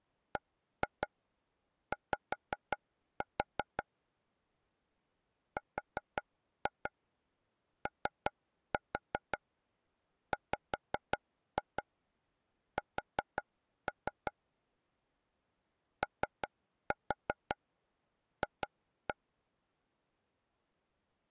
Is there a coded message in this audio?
Yes: tap code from 0.4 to 19.1 s, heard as taps on a table, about 5 knocks a second. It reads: BY ROWS OF